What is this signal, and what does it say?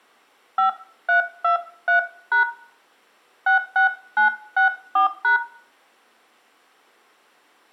DTMF, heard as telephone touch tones, dialled by hand, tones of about 120 ms, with room echo. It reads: 5323# 66964#